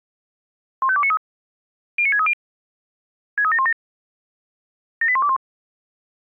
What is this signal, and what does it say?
Five-tone selective call (ZVEI), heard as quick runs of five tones, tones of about 70 ms. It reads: 15293 09630 63717 78121